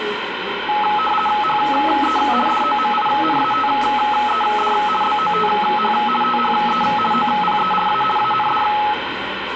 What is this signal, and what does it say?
RTTY (50 baud, 450 Hz shift), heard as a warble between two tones, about 1070 Hz centre, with radio static, room echo and the noise of a cafe. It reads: HE DOMINATED BOTH THE OPERA AND